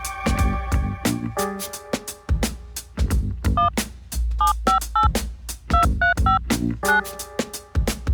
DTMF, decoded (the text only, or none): 1 758 235 9